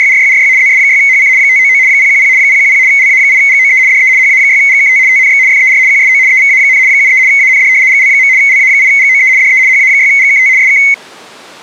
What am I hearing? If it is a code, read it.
RTTY (75 baud, 170 Hz shift), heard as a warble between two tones, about 2150 Hz centre. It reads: … ZS6HC 599 010 010 LA8GOE DE HA6GKT TNX FER QSO EVA, 73 AND GL. LA8GOE DE HA6GKT SK